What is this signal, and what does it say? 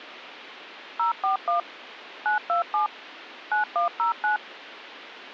DTMF, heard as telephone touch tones, dialled by machine, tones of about 120 ms. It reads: 041 927 9109